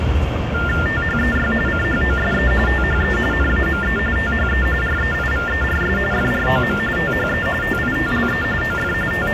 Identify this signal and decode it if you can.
TTY/TDD text telephone tones (45.45 baud Baudot), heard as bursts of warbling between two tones, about 400 Hz shift, 1600 Hz centre, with phone line noise and the noise of a crowd indoors. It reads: THEY CHOSE THE NAME THE REIVERS FROM THE TITLE OF …